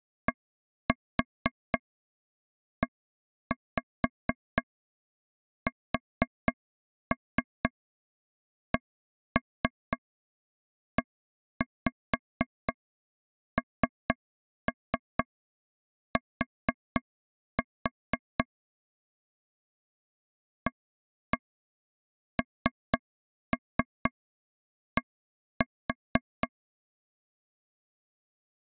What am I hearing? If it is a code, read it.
Tap code, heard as taps on a table, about 4 knocks a second. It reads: DESCENT AND